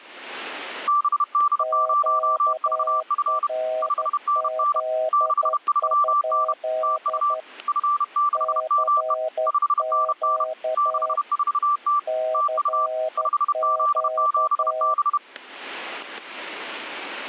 Morse code, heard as two keyed tones, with static crashes. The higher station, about 31 wpm, 1170 Hz: BD0VF 5NN 63N TU F6ME 5NN 64T TU 5Z7B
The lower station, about 12 wpm, 630 Hz: QRZ? CQ CQ